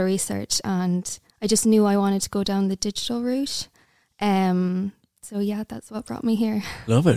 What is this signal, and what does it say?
Speech in English. There is no code.